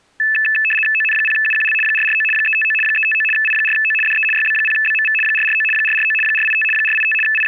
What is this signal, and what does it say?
RTTY (75 baud, 850 Hz shift), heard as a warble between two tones, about 2200 Hz centre. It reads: ON0UQL 449 359 359 I4O DE YB0BMV 449 449 485 485 …